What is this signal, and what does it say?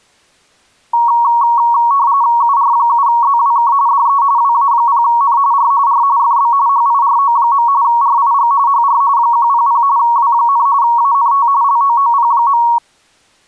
RTTY (45.45 baud, 170 Hz shift), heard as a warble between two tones, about 1030 Hz centre. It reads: UR7ZWK DE WA0N R R FB HIRO. RIG HR 100 W, ANT LOOP.